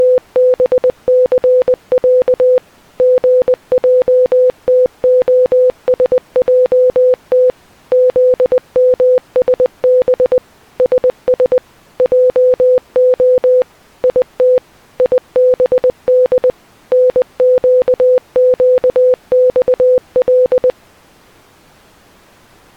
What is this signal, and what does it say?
Morse code (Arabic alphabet), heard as a keyed tone, machine-sent, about 20 wpm, 500 Hz. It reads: … غجتخسجت ذمسب سس جخ يت يبد نققصل